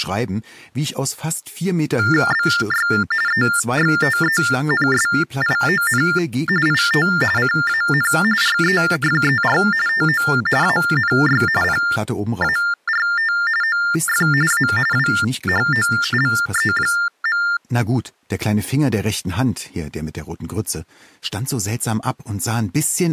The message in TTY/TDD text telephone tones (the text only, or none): BY EXTENSION IT CAN REFER TO ANY PART OF A WHOLE.